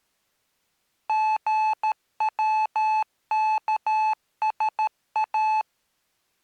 Morse code (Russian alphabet), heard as electronic beeps, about 13 wpm, 870 Hz. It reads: ГВКСА